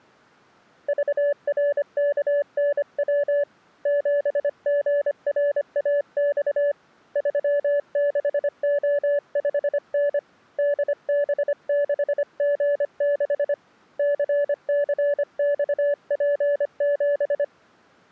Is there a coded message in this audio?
Yes: Morse code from 0.8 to 17.5 s, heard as a keyed tone, hand-sent with a paddle, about 25 wpm, 580 Hz. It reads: VRKNW 7GRAX 36O5N DB6G6 CCXP7